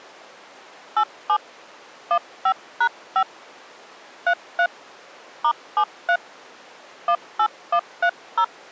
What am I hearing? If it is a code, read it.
DTMF, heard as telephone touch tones, dialled by hand, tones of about 70 ms. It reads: 87 15#5 33 *73 18130